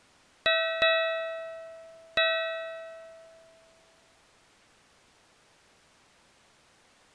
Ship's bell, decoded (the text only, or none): 3